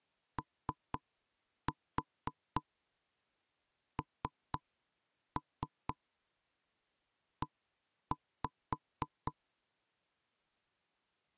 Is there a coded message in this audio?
Yes: tap code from 0.4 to 9.3 s, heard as knocks on wood, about 4 knocks a second. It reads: ONE